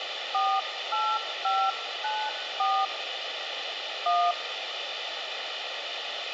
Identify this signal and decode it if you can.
DTMF, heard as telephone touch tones, dialled by hand, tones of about 250 ms, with radio hiss and a squelch burst at the end. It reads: 48594 1